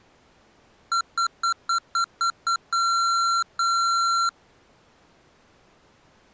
Beep code, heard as beeps from a small speaker, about 1360 Hz. 7 short, 2 long.